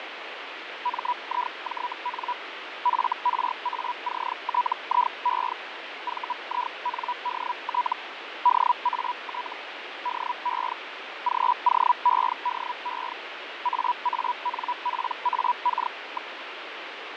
Hellschreiber (Feld-Hell, 122.5 baud), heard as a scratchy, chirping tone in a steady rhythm, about 980 Hz, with radio static and fading. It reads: MIJN FRACTIE VINDT DAT DE GOEDE AANPAK.